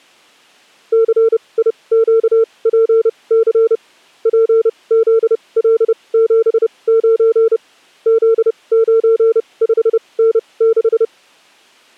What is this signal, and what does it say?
Morse code, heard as a keyed tone, machine-sent, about 30 wpm, spaced as for 23 wpm, 450 Hz. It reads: CIQPC PZL79 Z95N6